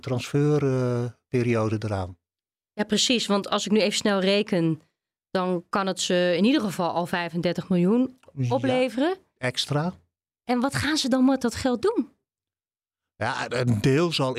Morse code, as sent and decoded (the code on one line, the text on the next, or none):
none